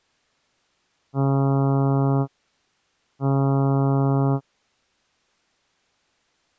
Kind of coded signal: ship horn signal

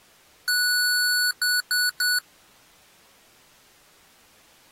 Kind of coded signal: beep code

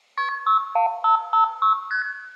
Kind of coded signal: multi-frequency trunk signalling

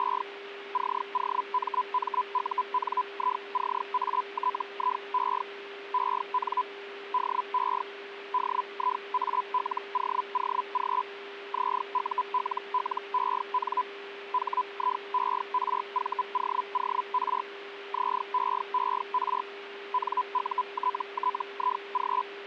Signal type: Hellschreiber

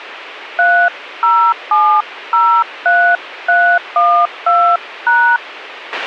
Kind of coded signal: DTMF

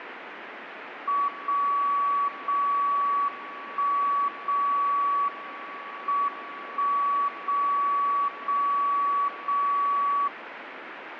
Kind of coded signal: radio time signal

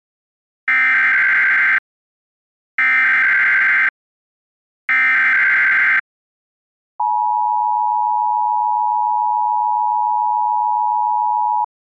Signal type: Emergency Alert System (SAME) tones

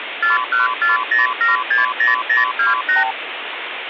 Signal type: multi-frequency trunk signalling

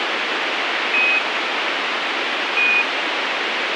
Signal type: Quindar tones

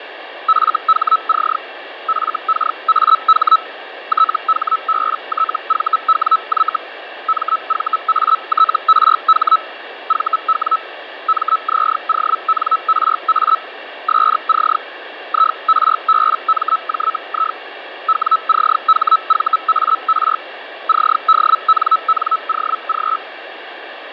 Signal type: Hellschreiber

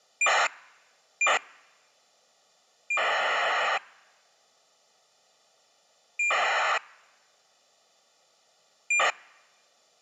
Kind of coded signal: ACARS aircraft data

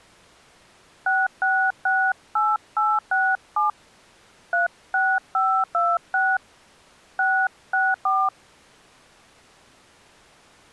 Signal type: DTMF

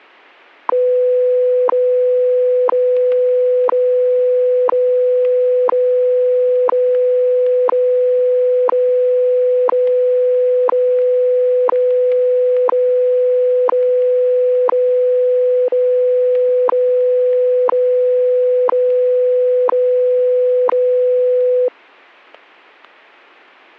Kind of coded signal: radio time signal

